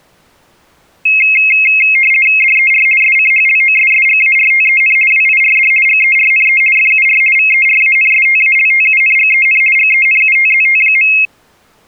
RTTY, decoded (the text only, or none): DER SCHLOSSGARTEN WIRD GERNE FUR VERANSTALTUNGEN GENUTZT.